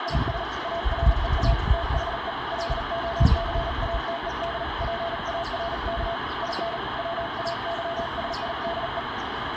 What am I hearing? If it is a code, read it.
Morse code, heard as a keyed tone, hand-sent with a paddle, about 38 wpm, 680 Hz, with heavy radio static and the noise of a residential street. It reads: IS AREA THE LOCATED PARK IN WAYSIDE